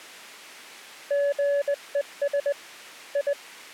Morse code, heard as a keyed tone, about 20 wpm, 570 Hz. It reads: GES I